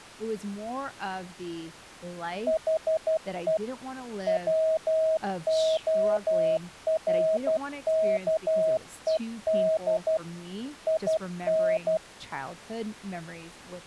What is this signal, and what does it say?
Morse code, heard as a keyed tone, machine-sent, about 12 wpm, 640 Hz, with speech in English. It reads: HE WORKED IN